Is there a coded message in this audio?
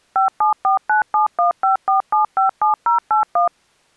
Yes: DTMF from 0.2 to 3.5 s, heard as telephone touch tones, dialled by machine, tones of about 120 ms. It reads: 57497154757081